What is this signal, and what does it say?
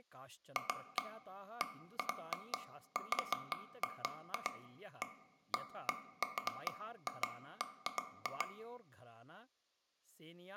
Irregular taps on a table, with room echo and speech in Sanskrit. There is no code.